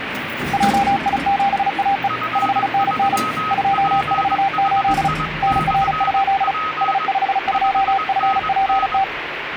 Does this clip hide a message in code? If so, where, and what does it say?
Yes: Morse code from 0.5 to 9.1 s, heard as two keyed tones, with radio static and the noise inside a lift. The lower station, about 35 wpm, 790 Hz: JI7AE 5NN 248 NR? S52FPT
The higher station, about 21 wpm, 1270 Hz: F3PHI/P 5NN